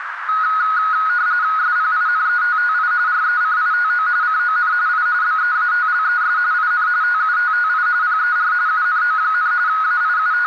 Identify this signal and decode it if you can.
RTTY (45.45 baud, 170 Hz shift), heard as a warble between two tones, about 1360 Hz centre, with radio static and a narrow filter. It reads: SPINETTI RECITO CON I BEATLES IN TUTTI PER UNO, …